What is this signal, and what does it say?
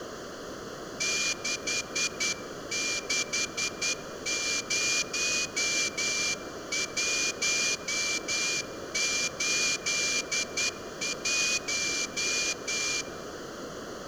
Morse code, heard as a whistle, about 10 wpm, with room echo. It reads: 660181